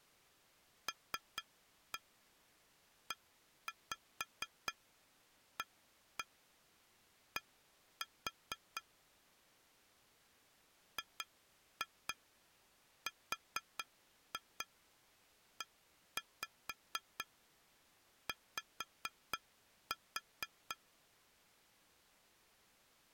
Tap code, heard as taps on glass, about 4 knocks a second. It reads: LEAD GREY